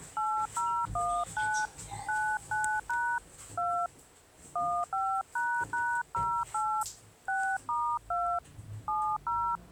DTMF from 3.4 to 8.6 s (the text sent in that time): 2 15##08 6*2